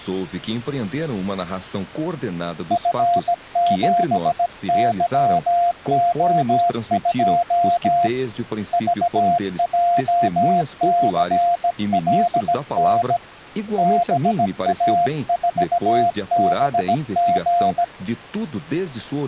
Morse code, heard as a keyed tone, hand-sent with a bug key, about 17 wpm, 700 Hz, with speech in Portuguese. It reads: F7YO2 VJCLN BA4BG